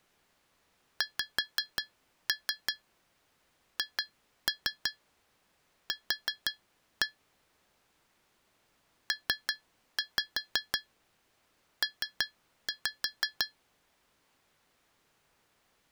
Tap code, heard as taps on glass, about 5 knocks a second. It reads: XHQ PP